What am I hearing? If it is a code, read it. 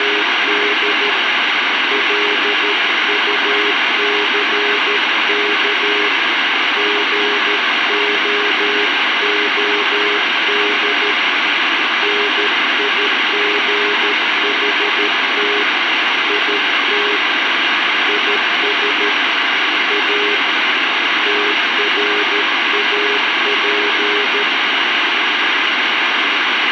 Morse code, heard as a keyed tone, hand-sent with a paddle, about 13 wpm, 410 Hz, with heavy radio static. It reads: … LUCK GOOD NIGHT IT IS A TRAP